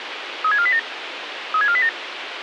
Five-tone selective call (ZVEI), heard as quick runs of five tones, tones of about 70 ms, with radio hiss. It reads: 36487 36487